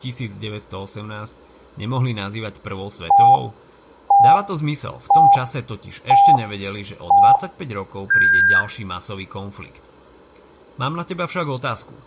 Radio time signal (five pips and a higher one, as on Chinese radio), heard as pips, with room echo and speech in Slovak.